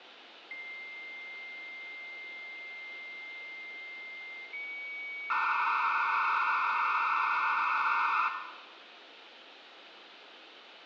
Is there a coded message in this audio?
Yes: dial-up modem handshake (low-speed, two carriers) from 0.5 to 8.3 s, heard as two whistles, then hiss, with phone line noise and room echo.